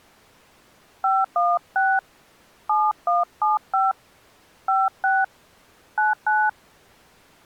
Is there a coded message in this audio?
Yes: DTMF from 1.0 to 6.5 s, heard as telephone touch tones, dialled by hand, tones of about 210 ms. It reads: 516 7175 56 99